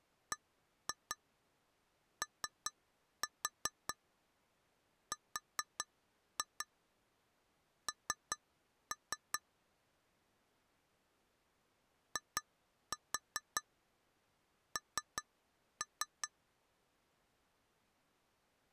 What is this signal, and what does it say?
Tap code, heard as taps on glass, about 5 knocks a second. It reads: BORN IN